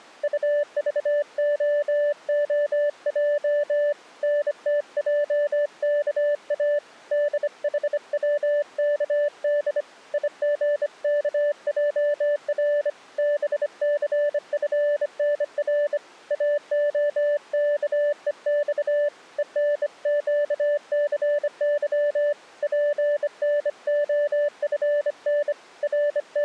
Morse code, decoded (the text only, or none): UVOOJ NTJKA DHWKD IGKJR BCFNR AOKEX ENQCY PNOFN …